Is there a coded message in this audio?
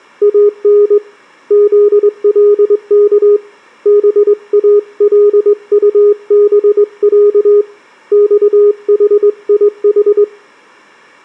Yes: Morse code (Arabic alphabet) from 0.2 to 10.3 s, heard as a keyed tone, hand-sent with a straight key, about 21 wpm, 410 Hz, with room echo. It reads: ان ذلك بالطبع صحيح